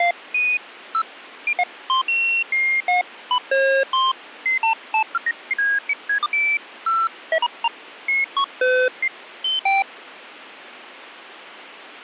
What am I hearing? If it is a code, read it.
Electronic bleeps of random pitch and length. There is no code.